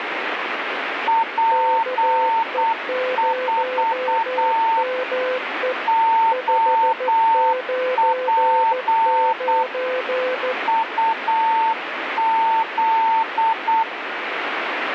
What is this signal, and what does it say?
Morse code, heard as two keyed tones, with radio static. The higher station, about 8 wpm, 900 Hz: P4 OP UZ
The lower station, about 14 wpm, 510 Hz: KE0ME 599